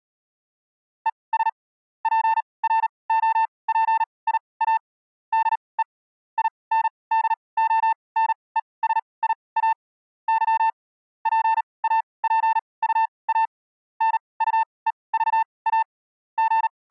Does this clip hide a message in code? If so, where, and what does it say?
Yes: Morse code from 1.0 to 16.9 s, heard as a keyed tone, machine-sent, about 38 wpm, spaced as for 24 wpm, 890 Hz. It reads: ES PROPIA DE INDONESIA Y PAPUA NUEVA …